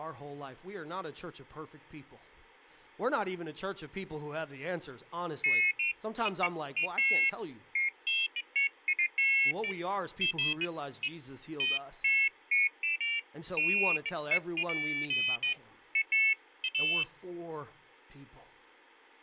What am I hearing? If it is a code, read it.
Pairs of high tones at irregular times, with speech in English. There is no code.